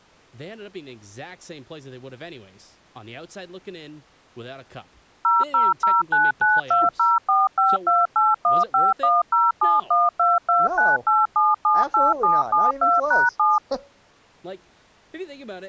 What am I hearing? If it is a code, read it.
DTMF, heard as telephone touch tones, dialled by machine, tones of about 190 ms, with speech in English. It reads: 000992045281510712298778772#7